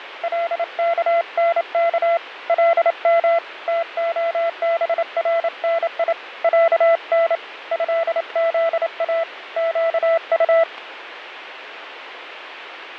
Morse code (Arabic alphabet), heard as a keyed tone, hand-sent with a paddle, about 28 wpm, 670 Hz, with radio static. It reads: لكنك لم تخبرني عن هذا قط